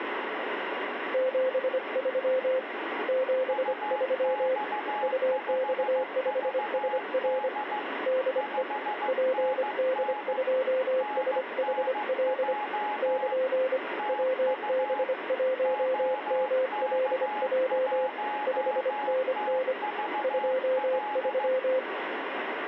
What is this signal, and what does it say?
Morse code, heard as two keyed tones, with radio static. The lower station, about 25 wpm, 520 Hz: 73 73 UX5SR DE PD2SHL <KN> WB1MLJ 5NN 23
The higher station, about 15 wpm, 840 Hz: UX5VD 5NN NNJ TU OK1TVL